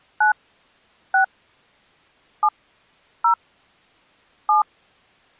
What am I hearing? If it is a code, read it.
DTMF, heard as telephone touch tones, dialled by hand, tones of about 100 ms. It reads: 9 6 7 0 7